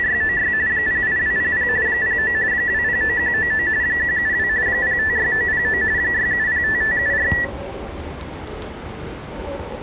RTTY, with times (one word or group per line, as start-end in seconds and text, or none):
0.0-0.5 …
0.7-1.7 08200
1.9-2.3 09
2.5-3.7 209199
3.8-4.5 172
4.7-5.8 056909
6.0-7.3 6705574